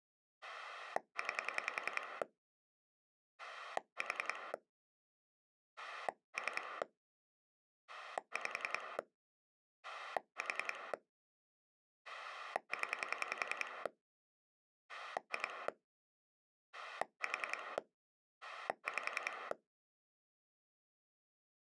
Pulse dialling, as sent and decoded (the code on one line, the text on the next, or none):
9 / 4 / 3 / 5 / 4 / 10 / 2 / 4 / 5
9 4 3 5 4 0 2 4 5